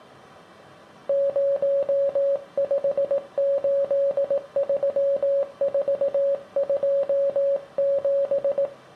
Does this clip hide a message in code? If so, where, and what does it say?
Yes: Morse code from 1.0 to 8.7 s, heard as a keyed tone, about 18 wpm, 560 Hz, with room echo. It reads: 0583427